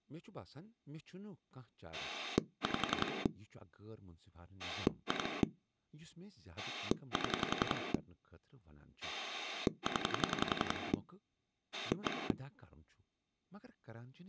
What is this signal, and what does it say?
Pulse dialling, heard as a rotary dial, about 11 pulses a second, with speech in Kashmiri. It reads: 5 2 7 0 1